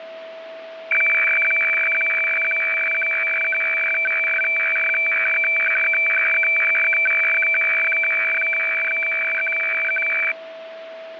Weather fax (radiofax), 120 lines a minute, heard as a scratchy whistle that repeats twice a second, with radio static and a steady whistle near 650 Hz.